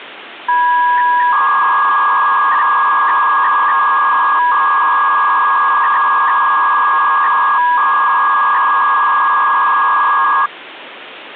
300-baud modem data (V.21 tones), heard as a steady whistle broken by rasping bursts, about 300 baud, 200 Hz shift, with phone line noise.